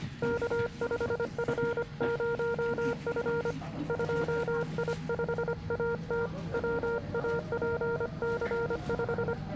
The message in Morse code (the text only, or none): K5F0F 2I5AT WAPC5